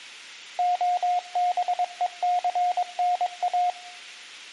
Morse code, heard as a keyed tone, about 22 wpm, 720 Hz, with room echo. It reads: OBECNA